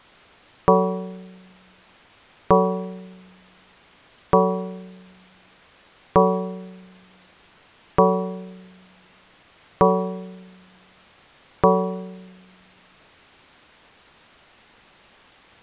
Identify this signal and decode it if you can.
Clock strike, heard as a bell. 7. Seven o'clock.